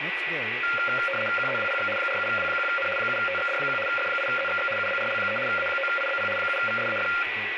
RTTY (75 baud, 850 Hz shift), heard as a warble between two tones, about 970 Hz centre, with radio static, a steady whistle near 1950 Hz, room echo and speech in English. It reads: QZWPX 47W1N 7TXD1 F8ZXX UBRL3 A9IBP 7VSAF